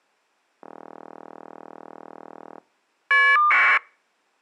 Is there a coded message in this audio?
Yes: caller ID data burst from 0.6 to 3.8 s, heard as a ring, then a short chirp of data, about 1200 baud.